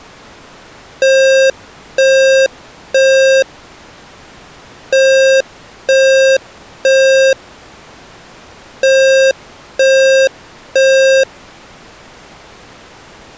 Alarm pattern, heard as an alarm's beeps, played three times, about 530 Hz. Temporal three. Smoke or fire, evacuate.